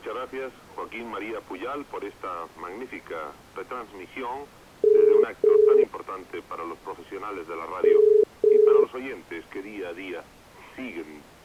Telephone call progress tone (as in the UK, Ireland, Australia and similar networks), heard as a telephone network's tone, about 430 Hz. Ringback tone.